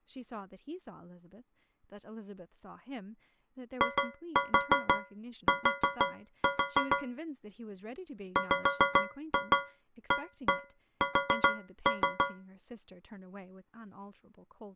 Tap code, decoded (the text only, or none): IT WAS